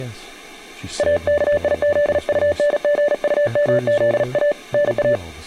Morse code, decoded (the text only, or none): AKIZUNGUMZA NA